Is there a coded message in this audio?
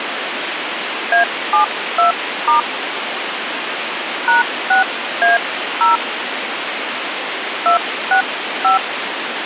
Yes: DTMF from 1.1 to 8.8 s, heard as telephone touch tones, dialled by hand, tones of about 120 ms, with phone line noise. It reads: A72* #6A0 265